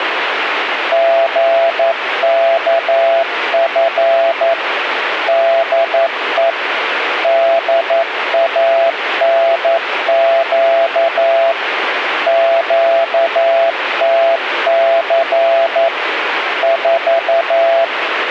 Morse code, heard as a keyed tone, machine-sent, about 11 wpm, 670 Hz, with radio static. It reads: GKF DE DANQ QTC 4